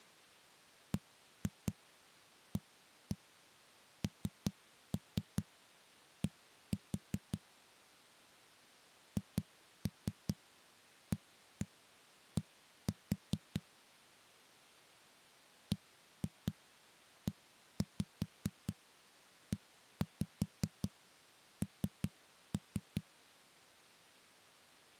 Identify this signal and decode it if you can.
Tap code, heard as knocks on a wall, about 5 knocks a second. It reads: BAND HAD BEEN